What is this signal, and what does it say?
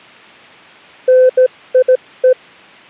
Morse code, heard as a keyed tone, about 16 wpm, 510 Hz. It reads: NIE